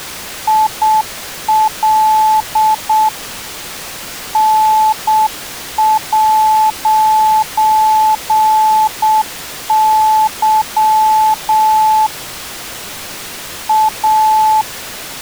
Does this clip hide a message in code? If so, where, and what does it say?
Yes: Morse code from 0.4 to 14.7 s, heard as a keyed tone, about 7 wpm, 870 Hz. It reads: IL N'Y A